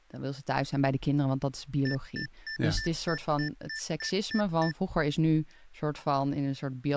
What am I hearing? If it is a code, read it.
Beep code, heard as beeps from a small speaker, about 1750 Hz, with speech in Dutch. 10 short. In AMI BIOS tables: CMOS shutdown register error.